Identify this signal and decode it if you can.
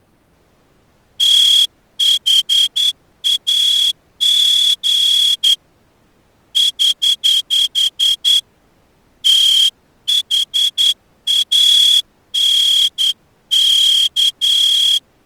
Morse code, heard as a whistle, hand-sent with a straight key, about 10 wpm. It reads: THAG <HH> THANK